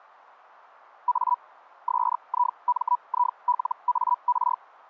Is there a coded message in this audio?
Yes: Hellschreiber (Feld-Hell, 122.5 baud) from 1.1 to 4.6 s, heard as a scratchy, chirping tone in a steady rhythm, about 980 Hz. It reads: A SIMILAR